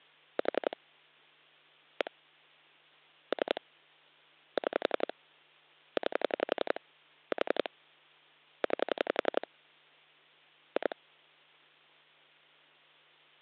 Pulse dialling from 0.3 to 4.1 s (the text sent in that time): 4 1 3